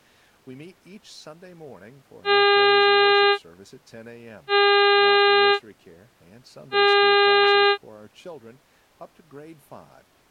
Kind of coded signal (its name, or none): ship horn signal